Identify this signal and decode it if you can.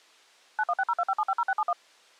DTMF, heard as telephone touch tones, dialled by machine, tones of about 50 ms. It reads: 916025750671